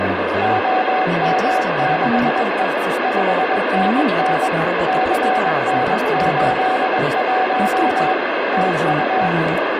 Morse code, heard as a keyed tone, machine-sent, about 21 wpm, 750 Hz, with heavy radio static and speech in Russian. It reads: OM6E 5NN CN81 TU